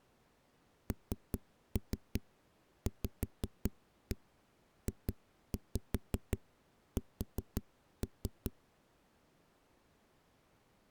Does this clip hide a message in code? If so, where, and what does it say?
Yes: tap code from 0.9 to 8.5 s, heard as knocks on a wall, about 5 knocks a second. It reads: NVJS